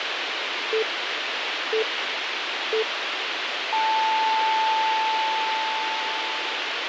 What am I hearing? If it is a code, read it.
Radio time signal (three low pips and a long one an octave up, as on NHK), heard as pips, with radio hiss.